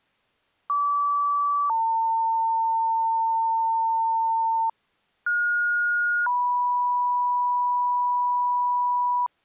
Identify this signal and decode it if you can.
Two-tone page, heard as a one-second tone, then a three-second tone, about 1150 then 900 Hz, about 1430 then 980 Hz.